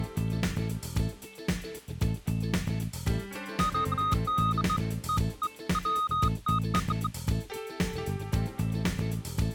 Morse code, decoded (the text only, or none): none